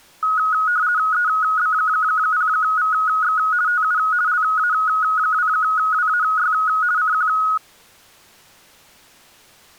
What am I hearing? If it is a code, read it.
RTTY (50 baud, 170 Hz shift), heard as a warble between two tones, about 1360 Hz centre. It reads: EB0VX TU LA2WAY CQ